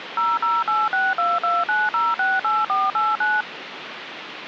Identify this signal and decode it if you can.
DTMF, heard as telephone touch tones, dialled by machine, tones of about 200 ms, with phone line noise. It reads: 0086229068489